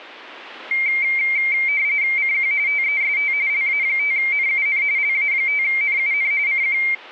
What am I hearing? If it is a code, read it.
RTTY (45.45 baud, 170 Hz shift), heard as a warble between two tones, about 2200 Hz centre. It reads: CQ TEST LA5NUN LA5NUN CQ